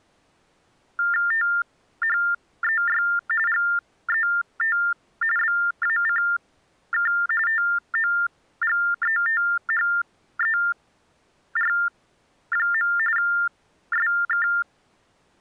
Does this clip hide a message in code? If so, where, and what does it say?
Yes: TTY/TDD text telephone tones (45.45 baud Baudot) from 1.0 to 14.6 s, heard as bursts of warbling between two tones, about 400 Hz shift, 1600 Hz centre. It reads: THEY GET BACK TOGETHER. SK